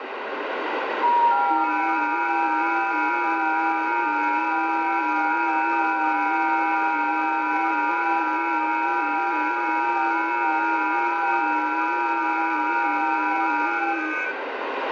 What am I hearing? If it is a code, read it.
FT8 (several signals at once), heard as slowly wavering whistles, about 6.25 baud, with radio static and room echo.